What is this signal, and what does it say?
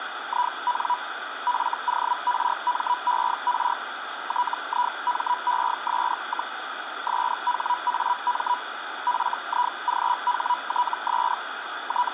Hellschreiber (Feld-Hell, 122.5 baud), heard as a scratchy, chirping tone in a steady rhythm, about 980 Hz, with radio static. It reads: IN FORMER TIMES, SHAM FIGHTS …